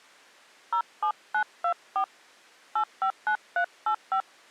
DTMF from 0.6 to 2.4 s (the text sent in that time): 07924